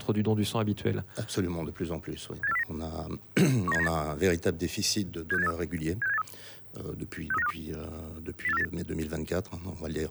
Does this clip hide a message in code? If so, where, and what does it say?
Yes: five-tone selective call (EEA) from 2.4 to 8.6 s, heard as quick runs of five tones, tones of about 40 ms. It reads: 78409 19798 76783 76783 63952 08498